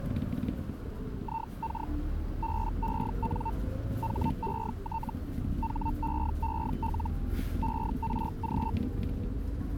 Hellschreiber (Feld-Hell, 122.5 baud), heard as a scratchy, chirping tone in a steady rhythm, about 900 Hz, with the noise inside a bus. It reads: IK BEN HET HEEL ERG